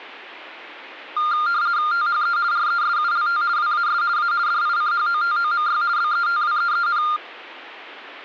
RTTY (50 baud, 170 Hz shift), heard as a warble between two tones, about 1300 Hz centre. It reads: THE RESULT WAS A DICHOTOMY BETWEEN